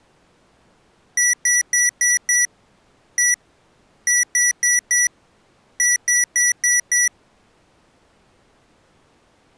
Beep code, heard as beeps from a small speaker, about 1950 Hz. 5-1-4-5.